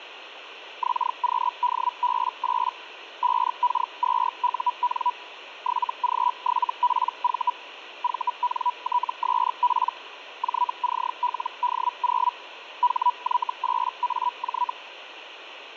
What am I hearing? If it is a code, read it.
Hellschreiber (Feld-Hell, 122.5 baud), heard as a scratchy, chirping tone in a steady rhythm, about 980 Hz, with radio static. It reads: XQDB8 5K2UN 7G7PV VNTSP JCLD0 HY8AJ